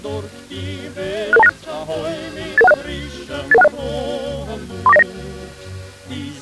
Five-tone selective call (EIA), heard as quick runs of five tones, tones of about 30 ms. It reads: 66296 88160 88160 34909